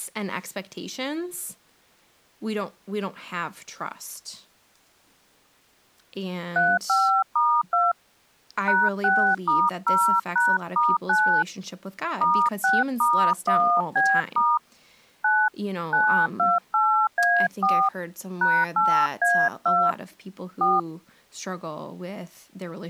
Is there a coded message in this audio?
Yes: DTMF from 6.6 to 20.8 s, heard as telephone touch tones, dialled by hand, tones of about 260 ms, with speech in English. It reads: 35*2 #6*0#*9 *6*1B* 9 928A4 #8A2 4